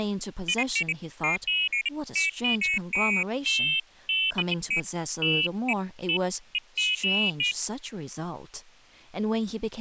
Pairs of high tones at irregular times, with speech in English. There is no code.